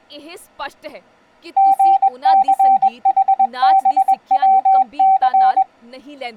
Morse code, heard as a keyed tone, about 21 wpm, 770 Hz, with speech in Punjabi. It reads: GCHBWC